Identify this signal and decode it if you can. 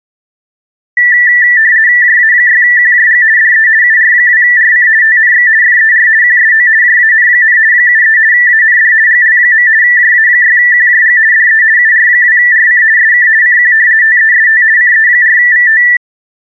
RTTY (50 baud, 170 Hz shift), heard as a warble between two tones, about 1850 Hz centre. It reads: JA6QJG DE UR2RC TNX FER QSO JAN, 73 AND GL. JA6QJG DE UR2RC SK CQ TEST CE4VT